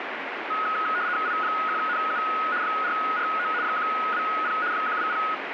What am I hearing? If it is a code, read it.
RTTY (75 baud, 170 Hz shift), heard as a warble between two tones, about 1360 Hz centre, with radio static. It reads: I1NU 449 120 120